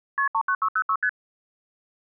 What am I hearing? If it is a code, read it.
Multi-frequency trunk signalling (R1, as on North American trunks), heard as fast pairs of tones, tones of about 70 ms. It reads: KP 39606 ST